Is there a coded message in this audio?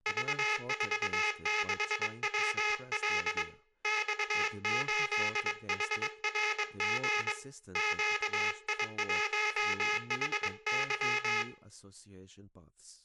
Yes: Morse code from 0.0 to 11.5 s, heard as a buzzer, hand-sent with a paddle, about 22 wpm, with room echo and speech in English. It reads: V46WL X8HRG QI1HY